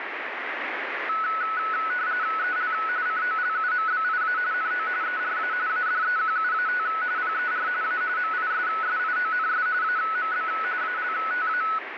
RTTY (45.45 baud, 170 Hz shift), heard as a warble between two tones, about 1390 Hz centre, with radio static. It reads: EL COLUMBIA NO ERA ADEQUAT PER A MISSIONS AMB ALTA